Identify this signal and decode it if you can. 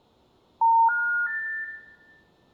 Telephone call progress tone (North American plan), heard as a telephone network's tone, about 910, 1430, 1800 Hz, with room echo. Special information tone.